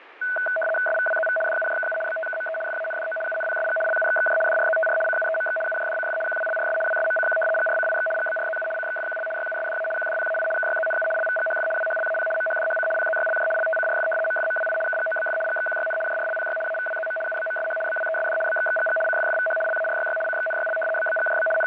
RTTY (75 baud, 850 Hz shift), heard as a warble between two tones, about 1070 Hz centre, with radio static. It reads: SVWZV DUJKU BTKME FANDO UNPSG LUXXJ DRZTR CUEMX UJDCF QWLRS WSMCQ GRCIX GBRZU CXFQL YUSDA QDPAI KYZNU LVGHF WHLAP MHDHC PZYLJ LTCRF MFMWI KGOBF GXQYN JRLPY AVWZM UBMSH BWESD BXXGG CFFVH LARYY CXNYL BBGJB …